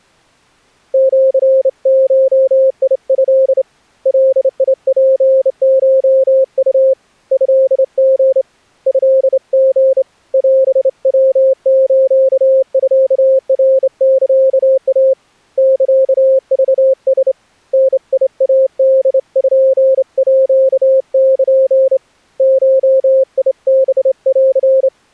Morse code (Japanese Wabun code), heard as a keyed tone, hand-sent with a straight key, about 28 wpm, 530 Hz. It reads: シゴト ガツコウ トリ トリ オヤスミナサイ サクラ ダイポール ゴハン